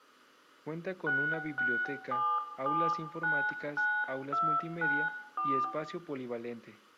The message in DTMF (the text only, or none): 667799294